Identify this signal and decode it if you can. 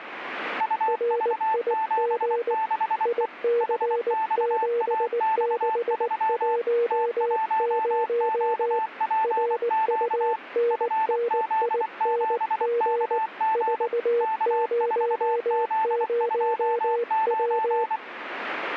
Morse code, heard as two keyed tones, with radio static. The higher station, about 24 wpm, 880 Hz: UV76E HXAX3 T1QPQ FZ7KG K4Z29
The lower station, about 19 wpm, 470 Hz: RIG IC7610 RUNNING 400W